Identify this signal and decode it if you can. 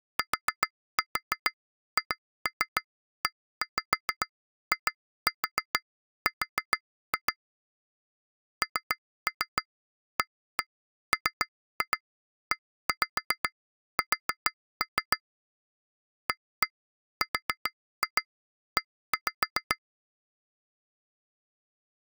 Tap code, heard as taps on glass, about 7 knocks a second. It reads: THEIR NAMES ARE